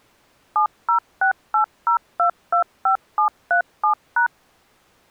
DTMF, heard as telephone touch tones, dialled by machine, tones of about 100 ms. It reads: 70680225737#